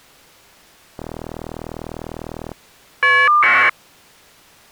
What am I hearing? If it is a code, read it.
Caller ID data burst, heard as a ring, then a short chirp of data, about 1200 baud.